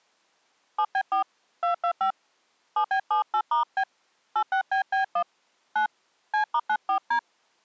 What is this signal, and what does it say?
DTMF, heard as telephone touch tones, dialled by hand, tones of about 90 ms. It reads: 7B4 225 7B78*B 86BB1 9 C*94D